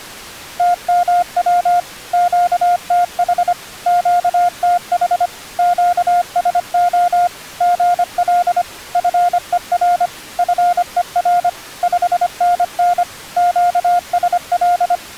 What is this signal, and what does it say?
Morse code, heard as a keyed tone, machine-sent, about 25 wpm, 710 Hz. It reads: TMW QTH QTH QSO GL FER FER 5NN QSL